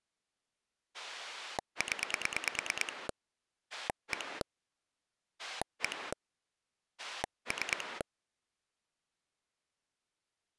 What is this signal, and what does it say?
Pulse dialling, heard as a rotary dial, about 9 pulses a second. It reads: 0 1 1 3